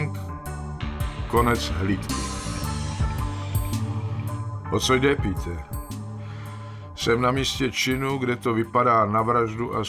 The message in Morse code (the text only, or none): none